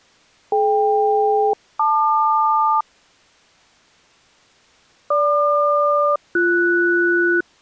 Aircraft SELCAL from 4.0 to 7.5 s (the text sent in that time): GQ-BS